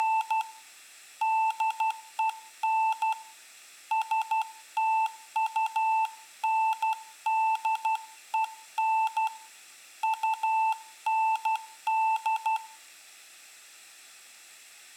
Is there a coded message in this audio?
Yes: Morse code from 0.0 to 12.6 s, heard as a keyed tone, hand-sent with a paddle, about 12 wpm, 880 Hz, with room echo. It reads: … DEN STUNDEN UND